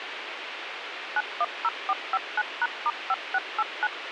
DTMF, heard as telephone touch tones, dialled by machine, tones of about 40 ms, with radio hiss. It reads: 910459#*5689